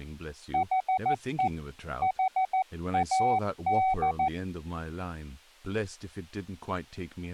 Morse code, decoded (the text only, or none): HE HAD